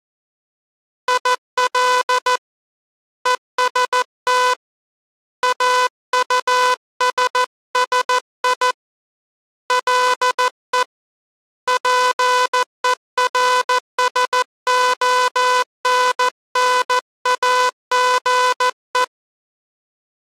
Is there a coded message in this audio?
Yes: Morse code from 1.0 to 19.1 s, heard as a buzzer, hand-sent with a paddle, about 14 wpm. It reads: IL EST AUSSI LE PERSONNAGE